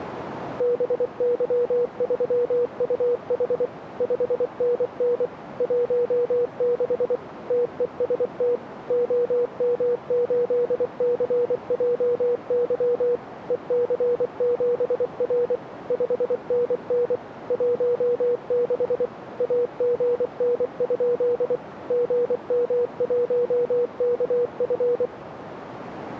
Morse code, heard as a keyed tone, machine-sent, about 24 wpm, 480 Hz, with radio static. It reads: BY3UH 5NN 16 TEST OM8CJY EC7R 5NN 16 AGN? GM1KF